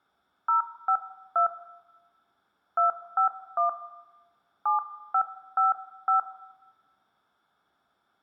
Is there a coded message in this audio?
Yes: DTMF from 0.5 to 6.2 s, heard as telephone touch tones, dialled by hand, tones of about 110 ms, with room echo. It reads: 052 251 7555